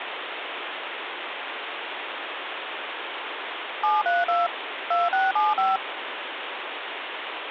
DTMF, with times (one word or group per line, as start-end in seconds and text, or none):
3.8-4.5 732
4.9-5.8 2675